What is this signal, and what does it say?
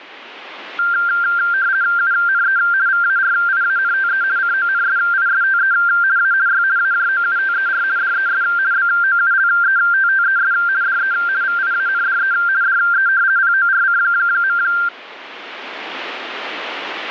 RTTY (50 baud, 170 Hz shift), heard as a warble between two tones, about 1480 Hz centre. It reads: UNE VARIANTE CONSISTE A Y AJOUTER DES BOULETTES DE VIANDE DE PORC.